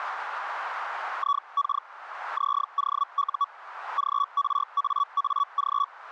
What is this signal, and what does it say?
Hellschreiber (Feld-Hell, 122.5 baud), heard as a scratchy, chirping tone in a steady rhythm, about 1130 Hz. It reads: IK ZOU GRAAG